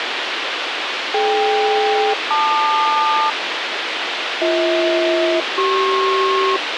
Aircraft SELCAL, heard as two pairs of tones, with radio hiss. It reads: DK-LQ BH-CP